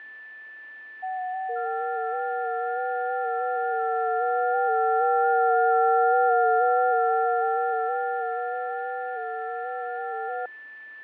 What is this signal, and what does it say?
FT8 (several signals at once), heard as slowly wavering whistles, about 6.25 baud, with fading and a steady whistle near 1760 Hz.